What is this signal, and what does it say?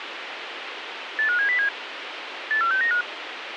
Five-tone selective call (CCIR), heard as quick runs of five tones, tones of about 100 ms, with radio hiss. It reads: 85707 84695